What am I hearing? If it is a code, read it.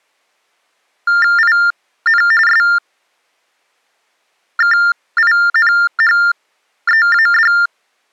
TTY/TDD text telephone tones (45.45 baud Baudot), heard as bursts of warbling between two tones, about 400 Hz shift, 1600 Hz centre. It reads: IN SKINHEAD